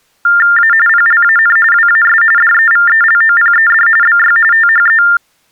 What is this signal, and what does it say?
TTY/TDD text telephone tones (45.45 baud Baudot), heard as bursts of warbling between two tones, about 400 Hz shift, 1600 Hz centre. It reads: A PLAN WAS DEVELOPED BY THE